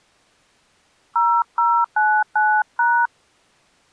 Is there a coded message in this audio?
Yes: DTMF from 1.2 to 3.1 s, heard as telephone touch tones, dialled by hand, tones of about 270 ms. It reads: 0099#